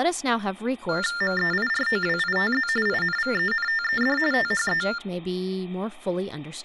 TTY/TDD text telephone tones (45.45 baud Baudot), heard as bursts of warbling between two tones, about 400 Hz shift, 1600 Hz centre, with speech in English. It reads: MEIROWITZ INVENTED THE